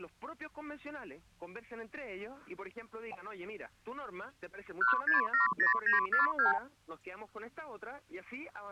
Multi-frequency trunk signalling (R2, with the far end's replies), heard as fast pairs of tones, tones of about 130 ms. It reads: 1670942